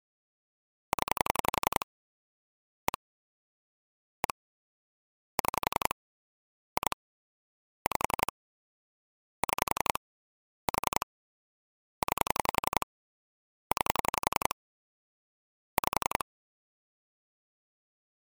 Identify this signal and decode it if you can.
Pulse dialling, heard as clicks on a phone line, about 11 pulses a second. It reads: 0 1 1 6 2 5 6 4 9 9 5